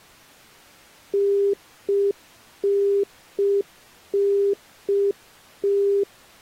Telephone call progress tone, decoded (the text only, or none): congestion tone